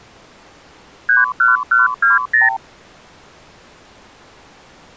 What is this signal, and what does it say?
Multi-frequency trunk signalling (R2, with the far end's replies), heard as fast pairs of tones, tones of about 160 ms. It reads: 31120